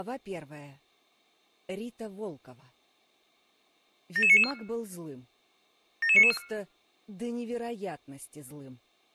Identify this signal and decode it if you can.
Five-tone selective call (ZVEI), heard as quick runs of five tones, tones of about 70 ms. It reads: 77994 77994